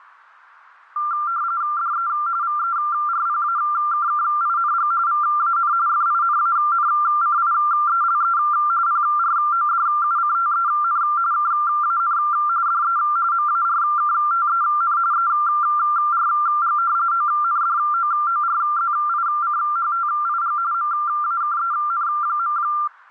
RTTY (45.45 baud, 170 Hz shift), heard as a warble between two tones, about 1280 Hz centre. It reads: DE VERPAKKING VAN FINANCIELE PRODUCTEN KAN DE MARKTEN ERG ONDOORZICHTIG MAKEN.